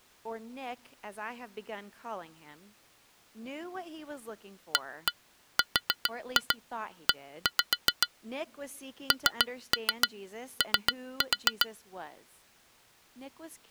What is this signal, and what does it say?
Tap code, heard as taps on glass, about 7 knocks a second, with speech in English. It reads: ARE NO